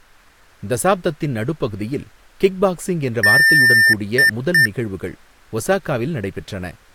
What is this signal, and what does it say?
Beep code, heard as beeps from a small speaker, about 1800 Hz, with speech in Tamil. 1 long, 2 short. In Award, IBM and AMI BIOS tables: video adapter failure.